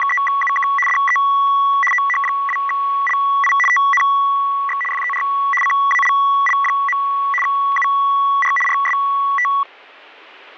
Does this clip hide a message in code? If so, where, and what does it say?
Yes: RTTY (75 baud, 850 Hz shift) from 0.0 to 9.6 s, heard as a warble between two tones, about 1550 Hz centre. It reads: … DE OH2LI TNX FER CALL. UR RST